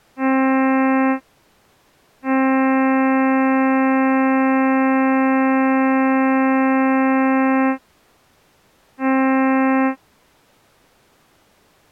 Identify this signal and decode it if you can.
Ship horn signal, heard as a ship's horn, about 260 Hz. 1 short, 1 long, 1 short. At sea: a vessel at anchor warns of its position.